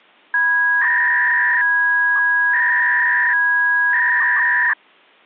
300-baud modem data (V.21 tones), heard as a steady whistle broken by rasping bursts, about 300 baud, 200 Hz shift.